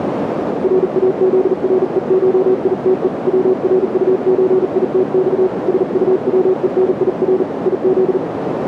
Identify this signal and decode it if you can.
Morse code (Russian alphabet), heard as a keyed tone, hand-sent with a paddle, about 39 wpm, 370 Hz, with radio static and a narrow filter. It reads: РАЗРЕШИТЕ ВРУЧИТЬ СУВЕНИР ИЗ